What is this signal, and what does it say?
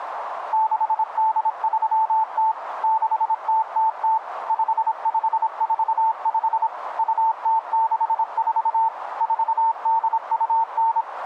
Morse code (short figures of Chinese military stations), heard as a keyed tone, machine-sent, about 26 wpm, 890 Hz, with radio static and a narrow filter. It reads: 6830 6000 5545 2064 4829